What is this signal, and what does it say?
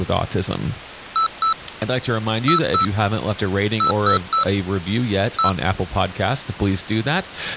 Beep code, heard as beeps from a small speaker, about 1320 Hz, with speech in English. 2-2-3-1. In Phoenix BIOS tables: unexpected interrupt.